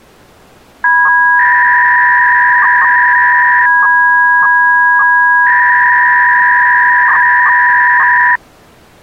300-baud modem data (V.21 tones), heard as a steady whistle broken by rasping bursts, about 300 baud, 200 Hz shift.